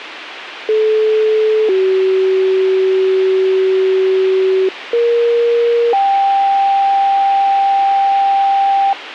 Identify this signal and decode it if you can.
Two-tone page, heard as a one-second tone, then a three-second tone, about 430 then 380 Hz, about 470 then 790 Hz, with radio hiss.